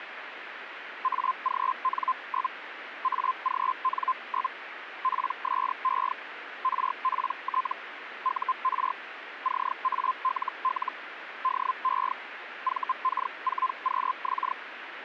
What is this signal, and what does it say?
Hellschreiber (Feld-Hell, 122.5 baud), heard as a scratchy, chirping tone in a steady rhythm, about 1040 Hz, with radio static. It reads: AGN? AGN? PSE RPT UR CALL DE VK4QX